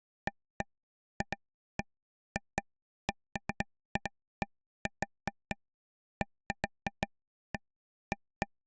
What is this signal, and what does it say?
Irregular taps on a table. There is no code.